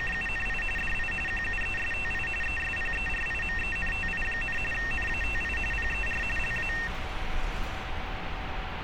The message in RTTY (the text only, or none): … DI QUESTI ESPERIMENTI, NATI PER LA